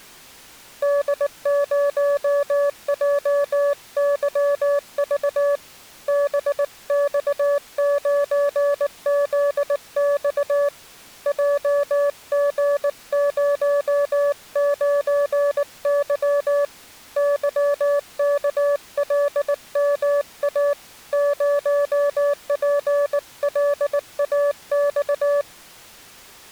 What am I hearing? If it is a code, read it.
Morse code, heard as a keyed tone, hand-sent with a bug key, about 19 wpm, 570 Hz. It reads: D0JYV BX9ZX JG09Y YKLMA 0PLAX